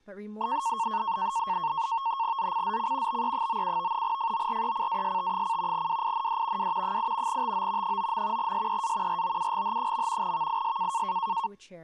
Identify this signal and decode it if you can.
NAVTEX (SITOR-B), 100 baud, 170 Hz shift, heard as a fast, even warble, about 1000 Hz centre, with speech in English. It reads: ZCZC BE97 FORECAST: WIND W 8 TO 9. SEA ROUGH. VIS